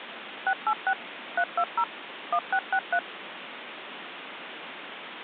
DTMF, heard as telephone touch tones, dialled by machine, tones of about 70 ms, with phone line noise. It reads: 686 320 1663